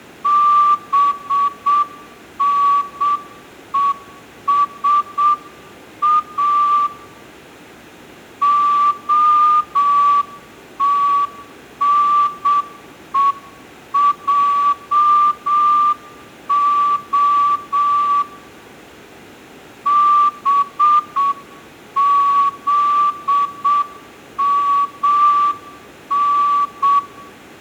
Morse code (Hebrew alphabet), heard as a whistle, hand-sent with a straight key, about 7 wpm, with room echo. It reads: בנושא התנועה בזמן